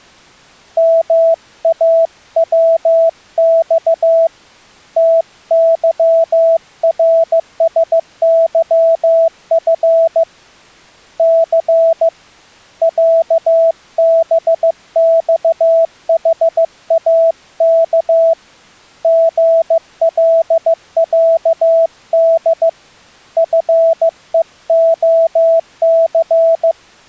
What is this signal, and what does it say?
Morse code (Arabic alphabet), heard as a keyed tone, hand-sent with a paddle, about 15 wpm, 660 Hz. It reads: ماوص تظرسظف ث عبصحاك غلعد فءخث